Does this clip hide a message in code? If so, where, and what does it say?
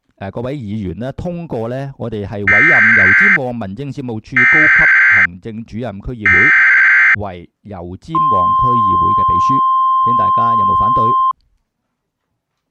Yes: Emergency Alert System (SAME) tones (header bursts, then the 1050 Hz attention tone) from 2.5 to 11.3 s, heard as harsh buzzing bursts, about 520.83 baud.